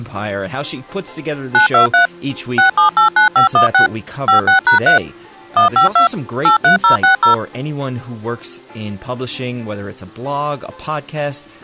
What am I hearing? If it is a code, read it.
DTMF, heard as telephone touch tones, dialled by machine, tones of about 120 ms. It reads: 923 6789516 56#3 152 83060